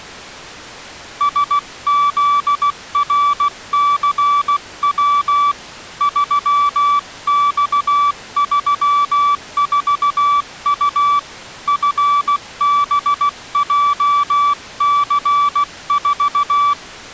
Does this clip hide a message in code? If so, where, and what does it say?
Yes: Morse code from 1.1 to 16.8 s, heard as a keyed tone, hand-sent with a paddle, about 16 wpm, 1160 Hz. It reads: SZRCW 3X34U FBJC4